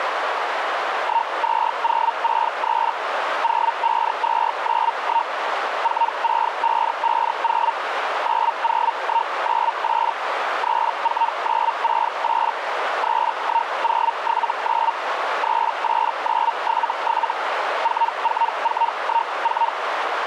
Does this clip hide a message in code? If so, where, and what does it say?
Yes: Hellschreiber (Feld-Hell, 122.5 baud) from 1.0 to 19.7 s, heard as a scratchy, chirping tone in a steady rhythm, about 920 Hz, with radio static and a narrow filter. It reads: 12063 05291 46550 90198 34968 31079 38977 44414